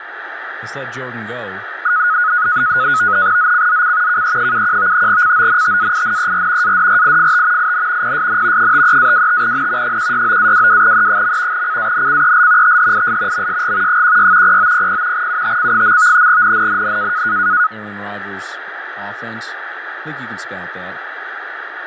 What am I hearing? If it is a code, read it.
NAVTEX (SITOR-B), 100 baud, 170 Hz shift, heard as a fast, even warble, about 1360 Hz centre, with radio static and speech in English. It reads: ZCZC KE71 CONTAINER ADRIFT IN PSN 53-25N 169-22E. CANCEL THIS MSG 16 0900 UTC. NNNN